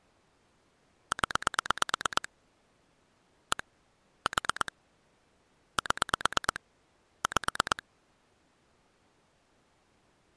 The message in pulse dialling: 0 1 4 7 5

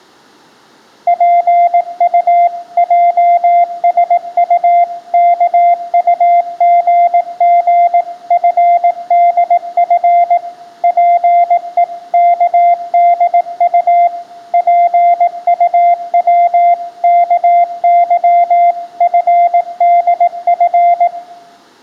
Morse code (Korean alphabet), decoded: 지혜있는 자의 집에는

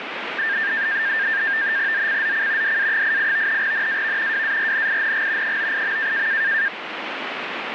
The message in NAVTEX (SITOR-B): ZCZC DA88 NAV WARNING 98.

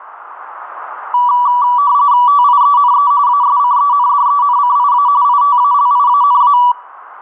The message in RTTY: TIENE ASCENDENCIA ITALIANA

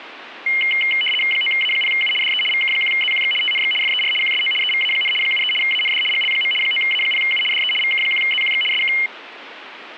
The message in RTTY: 9A0U DE VK1ZQX TNX FER QSO EVA, 73 AND GL. 9A0U DE VK1ZQX SK

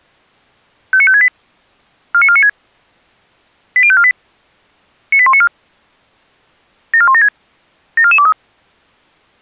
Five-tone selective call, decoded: 59568 49496 80548 98194 74176 74423

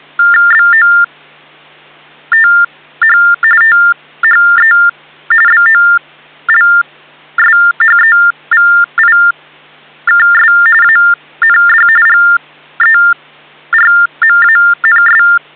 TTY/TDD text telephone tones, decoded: BOTH THE BOLSHEVIKS AND GERMANS

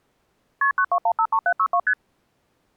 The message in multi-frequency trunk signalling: KP 92153762 ST

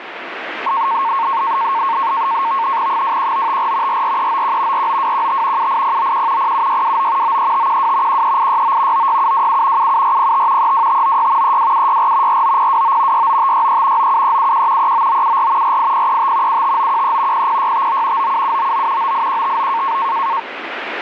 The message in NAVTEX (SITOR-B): 21954 44391 49215 78091 07629 93512 13869 96727 77405 32596 32764 49029 69563 97371 39974 48035 75913 00659 97799 98159

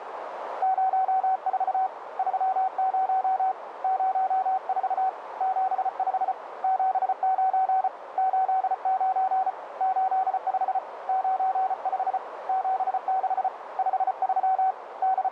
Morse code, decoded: 04 30 04 75 79 89 85 95 76 53 …

